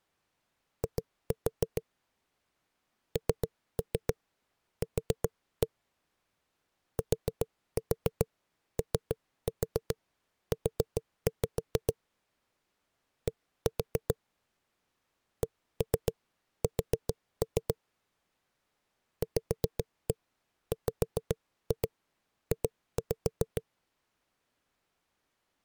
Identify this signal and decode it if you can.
Tap code, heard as knocks on a wall, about 7 knocks a second. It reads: I NQ TOU D CS VWJ